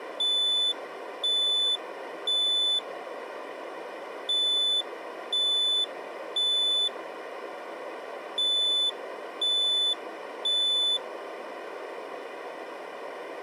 Alarm pattern, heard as an alarm's beeps, played three times, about 3500 Hz. Temporal three. Smoke or fire, evacuate.